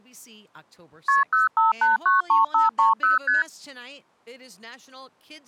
Multi-frequency trunk signalling (R1, as on North American trunks), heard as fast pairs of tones, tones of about 150 ms, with speech in English. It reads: KP 05893530 ST